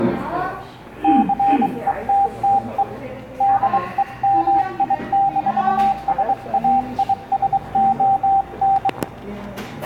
Morse code, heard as a keyed tone, hand-sent with a bug key, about 23 wpm, 790 Hz, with the noise of a cafe. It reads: CETTE DEMI-SAISON